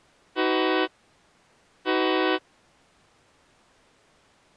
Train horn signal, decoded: 2 short

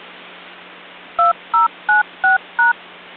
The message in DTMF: 2096#

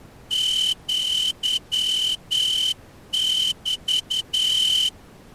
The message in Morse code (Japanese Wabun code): アメ

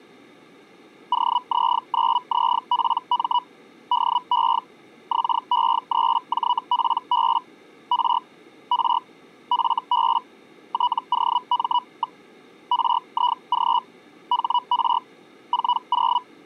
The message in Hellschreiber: OZ9ZPM DE XE3JPB R R FB TOM. RIG HR 40

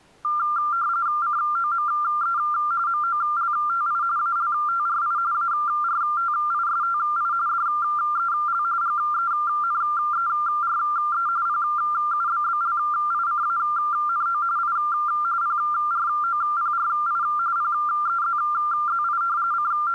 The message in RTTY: COME MOLTI ALTRI ARTISTI DEL GENERE PUBBLICANO I PROPRI PEZZI …

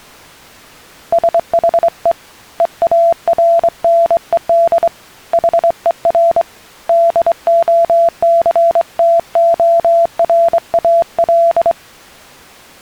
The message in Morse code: SHE EARNED HER DOCTORAL

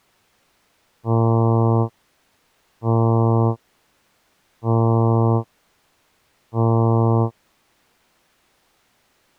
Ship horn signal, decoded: 4 short

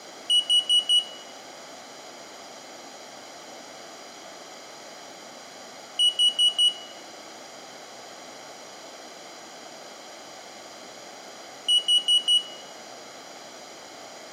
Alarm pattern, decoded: temporal four

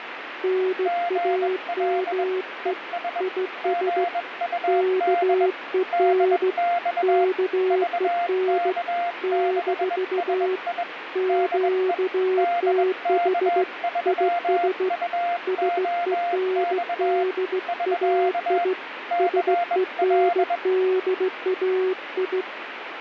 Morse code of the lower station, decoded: NAME IS KEN KEN - QTH IS SENDAI SENDAI

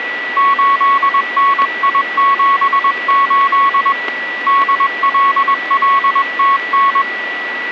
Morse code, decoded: 8NI78 DLLTN

